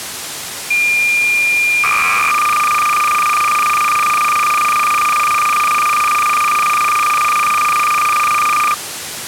Cassette data (Kansas City type), 300 baud, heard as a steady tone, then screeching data, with tape hiss.